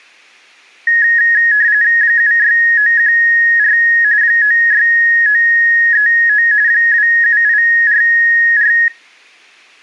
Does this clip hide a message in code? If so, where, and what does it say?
Yes: RTTY (45.45 baud, 170 Hz shift) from 0.9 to 8.9 s, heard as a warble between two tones, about 1800 Hz centre. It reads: 76914 96939 27844